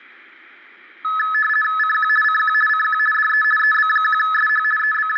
RTTY (50 baud, 450 Hz shift), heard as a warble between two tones, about 1500 Hz centre, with room echo. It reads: CQ CQ CQ DE EB1SH …